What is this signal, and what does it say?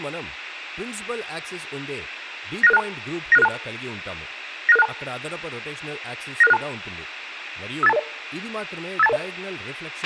Five-tone selective call (EIA), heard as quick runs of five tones, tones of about 30 ms, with a squelch burst at the end and speech in Telugu. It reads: 96662 96662 96662 96662 58220 58220